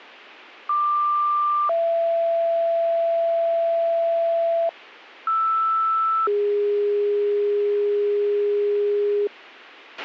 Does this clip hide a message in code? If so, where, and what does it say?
Yes: two-tone page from 0.7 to 9.3 s, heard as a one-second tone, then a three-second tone, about 1180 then 670 Hz, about 1320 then 410 Hz, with a squelch burst at the end.